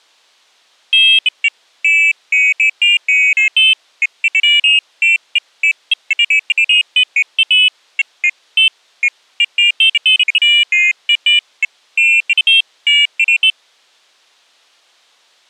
Pairs of high tones at irregular times. There is no code.